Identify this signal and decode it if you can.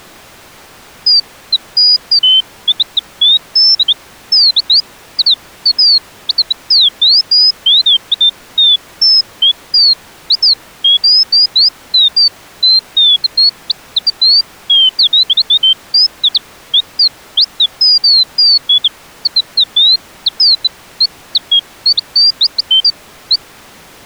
Bird-like chirps. There is no code.